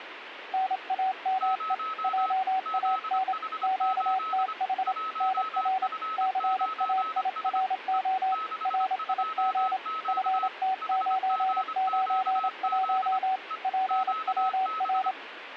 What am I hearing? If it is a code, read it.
Morse code, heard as two keyed tones, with radio static. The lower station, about 27 wpm, 760 Hz: NAME JAN QTH NR CAIRO RIG FT991 PWR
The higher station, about 25 wpm, 1290 Hz: 0 ZH8 1F9S E 62Q HGQZ E QB